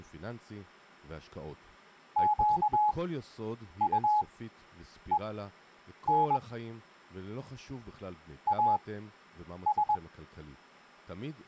Morse code, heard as a keyed tone, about 21 wpm, spaced as for 8 wpm, 840 Hz, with speech in Hebrew. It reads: QUEN AS